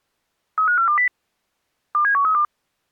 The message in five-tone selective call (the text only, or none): 35420 27132